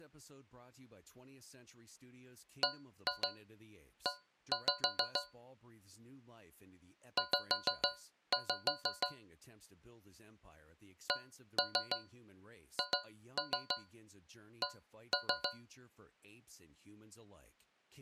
Tap code, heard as taps on a metal pipe, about 6 knocks a second, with speech in English. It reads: BE Z CHC